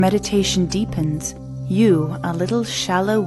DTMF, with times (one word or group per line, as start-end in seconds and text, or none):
none